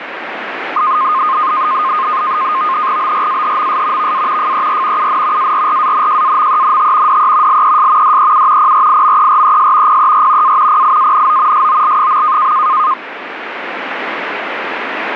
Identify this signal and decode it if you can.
NAVTEX (SITOR-B), 100 baud, 170 Hz shift, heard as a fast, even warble, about 1150 Hz centre, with radio static. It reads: BRAHMS VA FER UN ARRANJAMENT DE LES DEU PRIMERES PER A PIANO SOL.